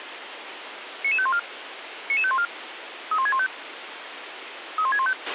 Five-tone selective call (ZVEI), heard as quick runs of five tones, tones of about 70 ms, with radio hiss and a squelch burst at the end. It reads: 99514 99514 31615 31615